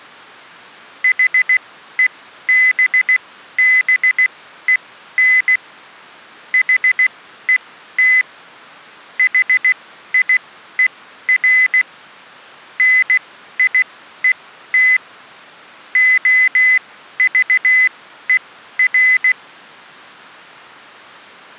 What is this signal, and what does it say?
Morse code, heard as a high beeper, machine-sent, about 16 wpm, spaced as for 12 wpm, 2000 Hz. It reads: HEBBEN HET HIER NIET OVER